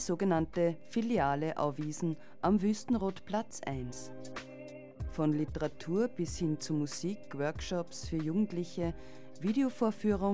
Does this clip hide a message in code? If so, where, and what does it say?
No.